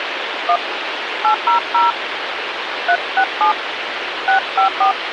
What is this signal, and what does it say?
DTMF, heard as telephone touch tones, dialled by hand, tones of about 120 ms, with phone line noise. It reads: 1 800 367 654